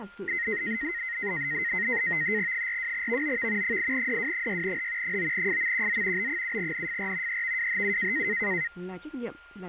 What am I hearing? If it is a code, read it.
NAVTEX (SITOR-B), 100 baud, 170 Hz shift, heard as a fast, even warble, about 1950 Hz centre, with a steady whistle near 1410 Hz and speech in Vietnamese. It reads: 42VOV 8DW6H 9FMQZ B7NFR EVWHU